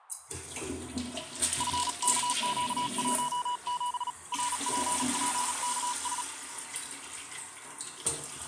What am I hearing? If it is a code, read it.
Morse code, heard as a keyed tone, hand-sent with a paddle, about 37 wpm, 980 Hz, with radio static and the noise of a restroom. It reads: FKQ17 RPPKS